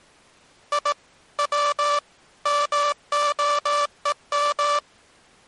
Morse code (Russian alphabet), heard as a buzzer, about 18 wpm. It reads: И В МОЕМ